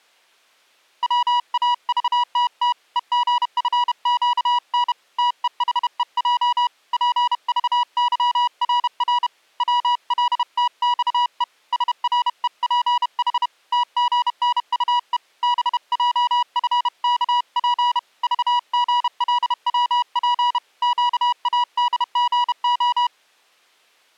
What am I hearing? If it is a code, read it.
Morse code, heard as a keyed tone, hand-sent with a bug key, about 31 wpm, 970 Hz. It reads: WAVTT EGFQN TEHEJ PVYRR WLTXE SREPH TGNUE BJFKP VGLWP QADGO